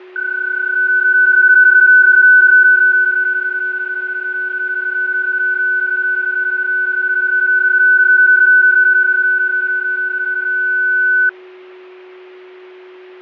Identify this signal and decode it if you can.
PSK31 (31.25 baud), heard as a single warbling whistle, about 1500 Hz, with fading and a steady whistle near 370 Hz.